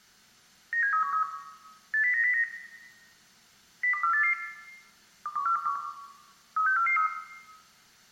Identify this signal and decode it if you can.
Five-tone selective call (CCIR), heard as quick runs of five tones, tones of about 100 ms, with room echo. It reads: 97313 80909 02488 21421 36443